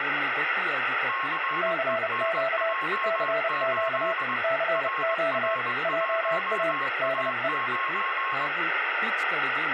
Morse code, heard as two keyed tones, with radio static and speech in Kannada. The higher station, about 21 wpm, 1080 Hz: CENJ8 RR1A9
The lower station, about 30 wpm, 660 Hz: CQ CQ CQ JA DE